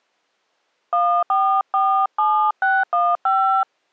DTMF, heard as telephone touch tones, dialled by hand, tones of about 300 ms. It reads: 1447615